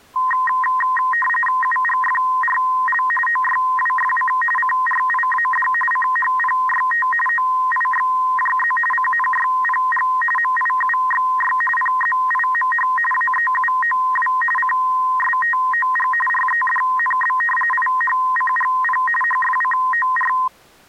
RTTY (45.45 baud, 850 Hz shift), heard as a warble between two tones, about 1450 Hz centre. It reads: UGFRL OYWFC CRIAD CHPYT OIXJZ CNYPG MIUXY PZIMH AEUOW CSTOG REDNB IHCGP HFCOR